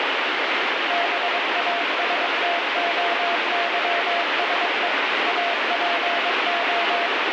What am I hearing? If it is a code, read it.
Morse code (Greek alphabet), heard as a keyed tone, machine-sent, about 22 wpm, 690 Hz, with heavy radio static. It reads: ΒΑΣΤΟΥΣΕ ΑΠΟ